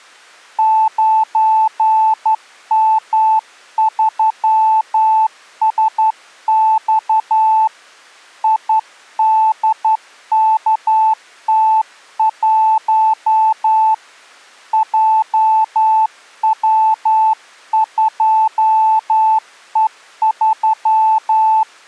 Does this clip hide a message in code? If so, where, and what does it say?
Yes: Morse code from 0.5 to 21.7 s, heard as a keyed tone, hand-sent with a straight key, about 11 wpm, 880 Hz. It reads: 9M3SX IDKT1 JW2E3